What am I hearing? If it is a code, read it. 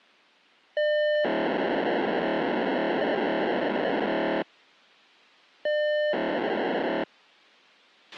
POCSAG pager data (1200 baud), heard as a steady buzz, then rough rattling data, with a squelch burst at the end.